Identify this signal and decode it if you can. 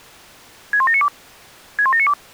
Five-tone selective call (ZVEI), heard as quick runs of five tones, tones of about 70 ms. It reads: 61792 61792